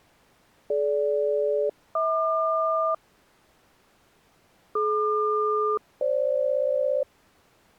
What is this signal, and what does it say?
Aircraft SELCAL, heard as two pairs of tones. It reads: DG-HQ DQ-FG